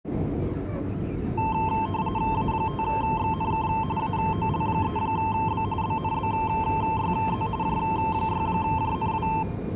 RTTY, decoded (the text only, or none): A5XNK AOL3B BNBYZ J6JNW